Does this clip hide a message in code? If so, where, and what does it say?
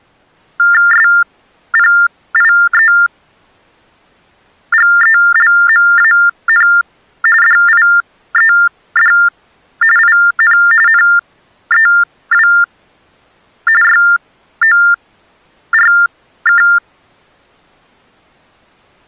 Yes: TTY/TDD text telephone tones (45.45 baud Baudot) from 0.6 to 16.8 s, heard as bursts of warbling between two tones, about 400 Hz shift, 1600 Hz centre. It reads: SPIEGELMAN DIED IN NEW YORK